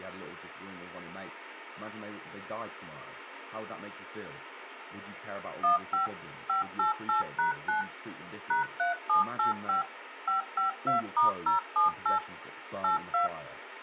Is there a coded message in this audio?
Yes: DTMF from 5.6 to 13.3 s, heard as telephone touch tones, dialled by machine, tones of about 130 ms, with speech in English. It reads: 15 588#9 #3785 552*078 82